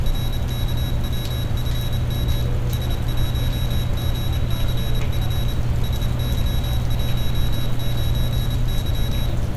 Morse code, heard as a high beeper, machine-sent, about 27 wpm, 3850 Hz, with room echo and street noise. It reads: RKWFM S1GCF SY19Y